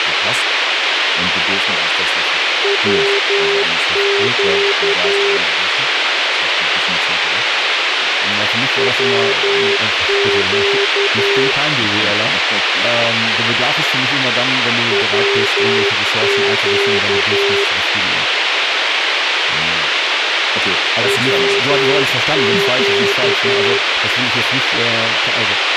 Morse code, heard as a keyed tone, machine-sent, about 11 wpm, 400 Hz, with radio hiss, a squelch burst at the end and speech in German. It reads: WQ WQ WQ WQ